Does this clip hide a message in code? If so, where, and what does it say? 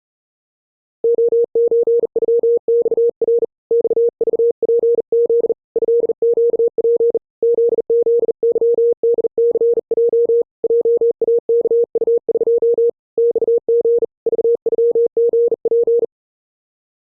Yes: Morse code (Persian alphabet) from 1.0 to 16.1 s, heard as a keyed tone, hand-sent with a bug key, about 40 wpm, 470 Hz. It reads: عچغخر خذپز ضگپ ززظدثج جاکطق خژ ذغژپ